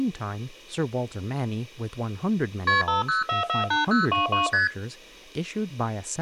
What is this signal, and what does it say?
Multi-frequency trunk signalling (R1, as on North American trunks), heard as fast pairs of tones, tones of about 140 ms, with speech in English. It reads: KP 50448022 ST